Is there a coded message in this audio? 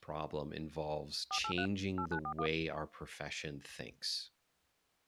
Yes: DTMF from 1.3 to 2.5 s, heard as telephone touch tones, dialled by machine, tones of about 80 ms, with speech in English. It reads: 483 8941